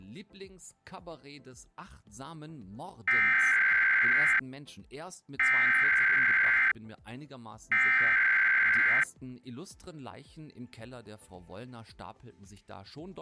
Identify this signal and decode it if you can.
Emergency Alert System (SAME) tones (header bursts), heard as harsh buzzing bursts, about 520.83 baud.